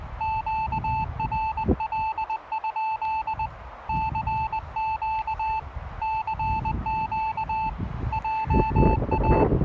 Morse code, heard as a keyed tone, hand-sent with a paddle, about 20 wpm, 880 Hz, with radio static and the noise of a residential street. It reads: QRL? CQ CQ JA